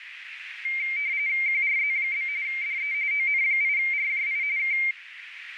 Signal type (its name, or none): RTTY